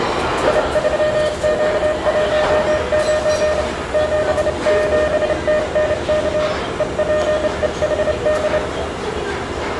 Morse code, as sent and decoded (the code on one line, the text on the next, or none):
.. ...-- --.- .---- ----. / --... --... - -. -.- / . .--. . .... -..
I3Q19 77TNK EPEHD